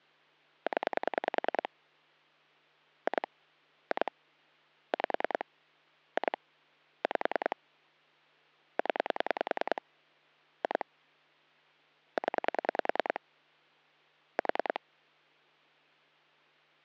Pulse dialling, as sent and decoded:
10 / 2 / 2 / 5 / 2 / 5 / 10 / 2 / 10 / 4
0 2 2 5 2 5 0 2 0 4

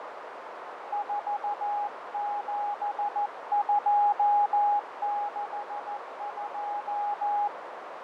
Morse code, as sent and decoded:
....- --... ..--- -.... ..---
47262

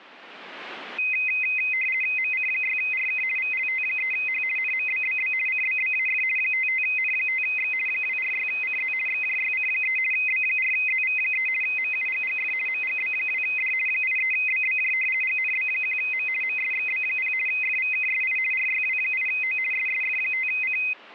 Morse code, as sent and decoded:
none

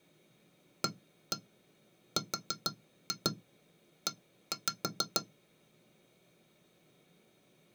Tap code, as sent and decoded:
1-1 4-2 1-5
ARE

